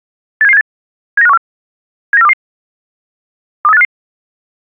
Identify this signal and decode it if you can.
Five-tone selective call (EEA), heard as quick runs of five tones, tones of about 40 ms. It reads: 87778 79514 79422 23855